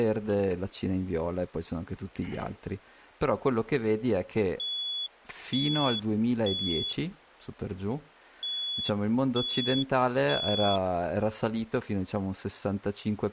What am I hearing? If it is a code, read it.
Alarm pattern, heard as an alarm's beeps, played twice, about 3400 Hz, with speech in Italian. Temporal three. Smoke or fire, evacuate.